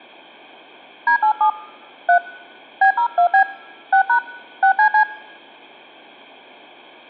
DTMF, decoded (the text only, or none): D87 3 B02B 6# 6CC